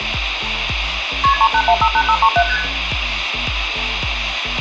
Multi-frequency trunk signalling (R1, as on North American trunks), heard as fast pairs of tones, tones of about 70 ms, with phone line noise and room echo. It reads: KP 38158537 ST